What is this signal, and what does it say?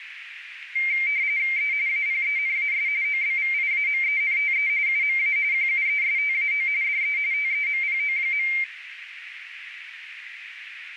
RTTY (45.45 baud, 170 Hz shift), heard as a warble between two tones, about 2200 Hz centre, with radio static and a narrow filter. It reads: E APENAS OBVIAMENTE UMA QUESTAO DE TEMPO.